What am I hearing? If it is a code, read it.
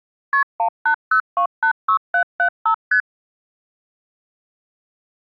Multi-frequency trunk signalling (R1, as on North American trunks), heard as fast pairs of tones, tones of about 90 ms. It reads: KP 180286775 ST